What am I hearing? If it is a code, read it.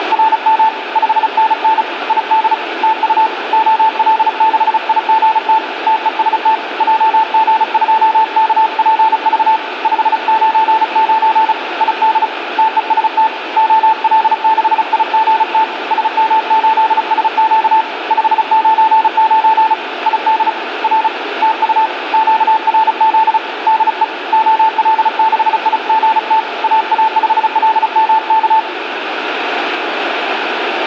Morse code, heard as a keyed tone, hand-sent with a paddle, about 35 wpm, 880 Hz, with radio static and room echo. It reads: … 5NN ID TU OL6IGT TEST JG2KPV 599 ID TEST OL6IGT SM8SQ 599 ID R TU QRZ DE OL6IGT AA5LMK